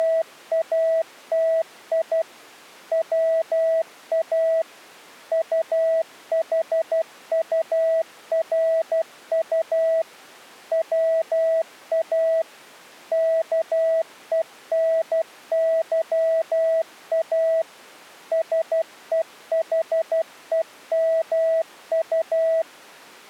Morse code, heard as a keyed tone, machine-sent, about 12 wpm, 650 Hz. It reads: … WA UHURU WA KENYA SEHEMU